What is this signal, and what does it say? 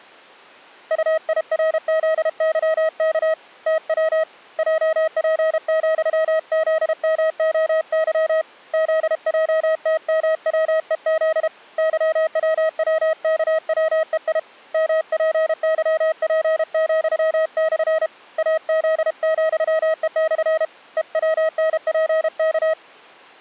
Morse code, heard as a keyed tone, hand-sent with a paddle, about 32 wpm, 640 Hz. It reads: UIRZYK TW JP,ZMOY ZJTMWEZ YWWKWEI MPYP,/ AZ,E/ EWNPK